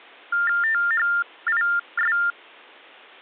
TTY/TDD text telephone tones (45.45 baud Baudot), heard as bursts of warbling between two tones, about 400 Hz shift, 1600 Hz centre. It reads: THIS